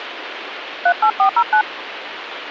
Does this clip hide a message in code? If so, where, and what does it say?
Yes: DTMF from 0.9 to 1.6 s, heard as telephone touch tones, dialled by hand, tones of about 90 ms, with phone line noise. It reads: 38409